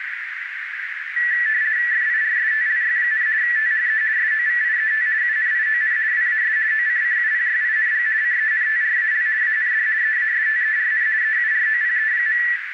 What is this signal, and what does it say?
RTTY (50 baud, 170 Hz shift), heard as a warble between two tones, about 1850 Hz centre, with radio static and a narrow filter. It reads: FIRSTLY, THE SOVIET UNION WAS OCCUPYING CENTRAL AND EASTERN EUROPE.